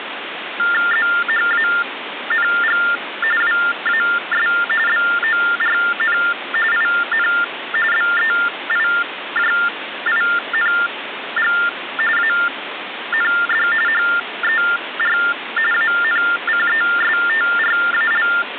TTY/TDD text telephone tones (45.45 baud Baudot), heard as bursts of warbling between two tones, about 400 Hz shift, 1600 Hz centre, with phone line noise. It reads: ZHANG WAS BORN IN BEIJING AND HER ANCESTRAL